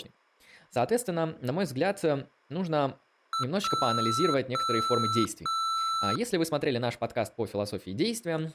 Beep code, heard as beeps from a small speaker, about 1330 Hz, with speech in Russian. 1 short, 3 long.